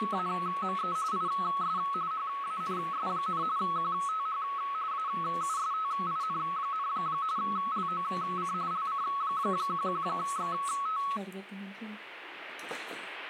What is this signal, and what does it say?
RTTY (45.45 baud, 170 Hz shift), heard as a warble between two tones, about 1200 Hz centre, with radio static. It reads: … IS HANS, QTH AUSTIN, LOC LC11XT